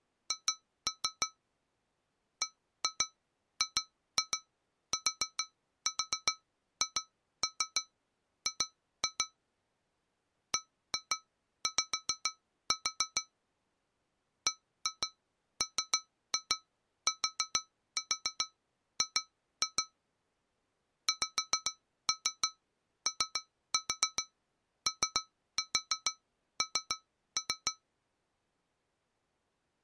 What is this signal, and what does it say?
Tap code, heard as taps on glass, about 6 knocks a second. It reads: H BGTHG BY BMTG XOON